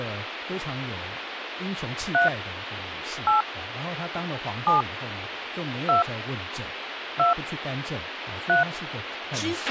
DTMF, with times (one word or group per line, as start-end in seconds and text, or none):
2.1-2.3 3
3.3-3.4 8
4.7-4.8 7
5.9-6.0 2
7.2-7.3 2
8.5-8.6 3